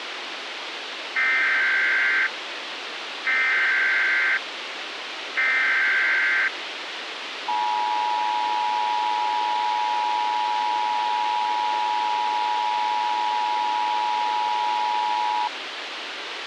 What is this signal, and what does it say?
Emergency Alert System (SAME) tones (header bursts, then the 853 and 960 Hz attention tone), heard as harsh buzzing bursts, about 520.83 baud, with radio hiss.